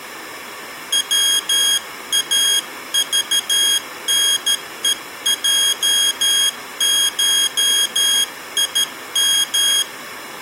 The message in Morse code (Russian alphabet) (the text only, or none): ВАЖНЕЙШИМ